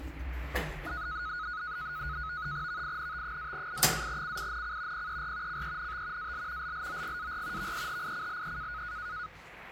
NAVTEX (SITOR-B), 100 baud, 170 Hz shift, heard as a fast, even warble, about 1360 Hz centre, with radio static and the noise of a restroom. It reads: VINT-I-CINC PER CENT AL LLOGAR VEHICLE